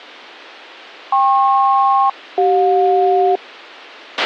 Aircraft SELCAL, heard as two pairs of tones, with a squelch burst at the end. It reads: KP-CJ